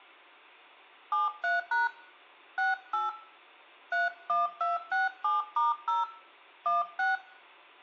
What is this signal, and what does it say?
DTMF, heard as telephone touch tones, dialled by hand, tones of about 160 ms, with room echo. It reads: 73# 68 31267*0 16